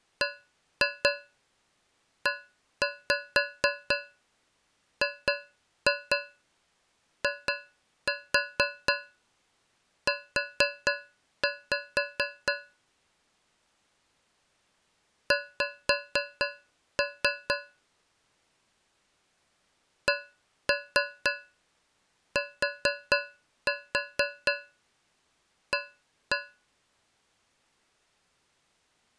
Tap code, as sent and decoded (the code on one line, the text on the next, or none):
1-2 1-5 2-2 2-4 4-5 / 5-3 / 1-3 4-4 1-1
BEGIU X CTA